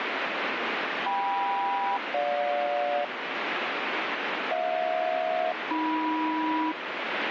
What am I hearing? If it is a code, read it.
Aircraft SELCAL, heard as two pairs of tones, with radio static. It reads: KM-GJ HJ-AM